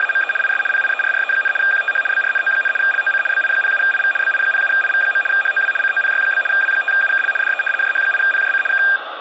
RTTY (75 baud, 850 Hz shift), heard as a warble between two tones, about 2000 Hz centre, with radio static. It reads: … IS PIERRE, QTH BRNO, LOC BI07IV BI07IV. HOW COPY? W5UKL DE JH8PJC K